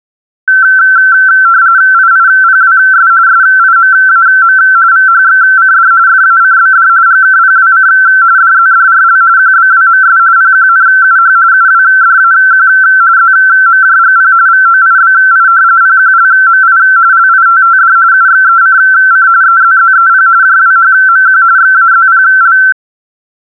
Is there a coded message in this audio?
Yes: RTTY (45.45 baud, 170 Hz shift) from 0.5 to 22.7 s, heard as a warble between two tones, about 1440 Hz centre. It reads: IIPWS SIMAM VHXCD FACBD GKPWC DZDRL QBWMS PQNUH UWDAQ ZMJGP VOIBI PQLMI LITTD UXECC EZZEP JWHMQ XAZPL